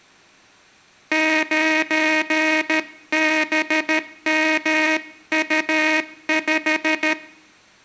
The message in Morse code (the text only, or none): 9BMU5